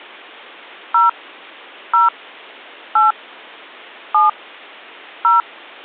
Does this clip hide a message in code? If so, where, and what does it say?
Yes: DTMF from 0.9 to 5.4 s, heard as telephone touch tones, dialled by hand, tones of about 150 ms. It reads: 0 0 8 7 0